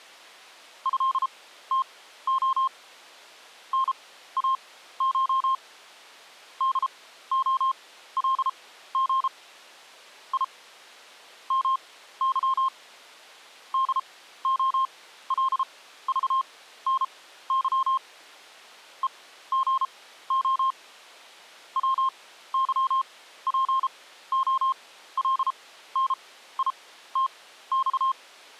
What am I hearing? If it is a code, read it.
Morse code (Russian alphabet), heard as a keyed tone, machine-sent, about 33 wpm, spaced as for 15 wpm, 1060 Hz. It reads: ЭТО НАШ ДОЛГ И МЫ ДОЛЖНЫ ЕГО ВЫПОЛНИТЬ